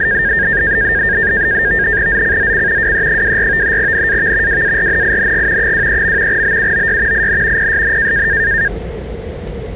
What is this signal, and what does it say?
NAVTEX (SITOR-B), 100 baud, 170 Hz shift, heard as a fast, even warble, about 1700 Hz centre, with the noise inside a subway train. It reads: ZCZC WE24 NAV WARNING 23. BUOY IN PSN